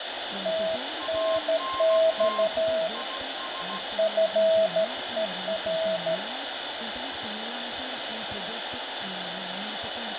Morse code, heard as two keyed tones, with radio static. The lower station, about 13 wpm, 650 Hz: TNX FER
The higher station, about 16 wpm, 1060 Hz: ANT IS